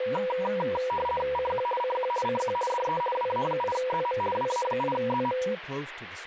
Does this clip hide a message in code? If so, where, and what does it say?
Yes: RTTY (50 baud, 450 Hz shift) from 0.0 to 5.5 s, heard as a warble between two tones, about 740 Hz centre, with radio static and speech in English. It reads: CQ CQ CQ DE WA8ZM WA8ZM